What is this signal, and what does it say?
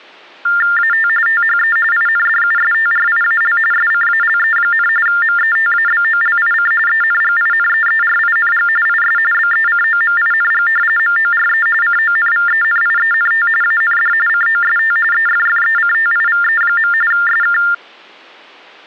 TTY/TDD text telephone tones (45.45 baud Baudot), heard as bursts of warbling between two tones, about 400 Hz shift, 1600 Hz centre. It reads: AT THE INDUSTRIAL SCALE, METABOLIC ENGINEERING IS BECOMING MORE CONVENIENT AND COST EFFECTIVE. SK